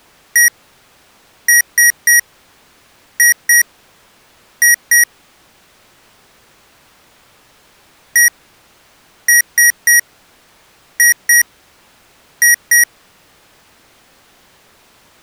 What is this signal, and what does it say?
Beep code, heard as beeps from a small speaker, played twice, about 1900 Hz. 1-3-2-2.